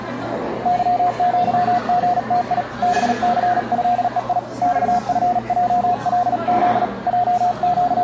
Morse code (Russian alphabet), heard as a keyed tone, hand-sent with a paddle, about 38 wpm, 720 Hz, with the noise of a crowd indoors. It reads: ЫЪГТИ БЦЭЕИ ЬФЙЛЗ …